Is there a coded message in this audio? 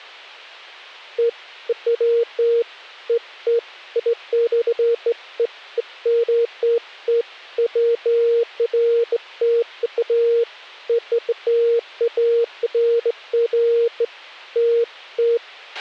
No, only beeps of irregular length, with a squelch burst at the end.